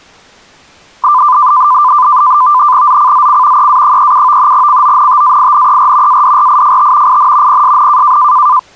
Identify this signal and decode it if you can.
NAVTEX (SITOR-B), 100 baud, 170 Hz shift, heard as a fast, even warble, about 1100 Hz centre. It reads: ZCZC EA37 CONTAINER ADRIFT IN PSN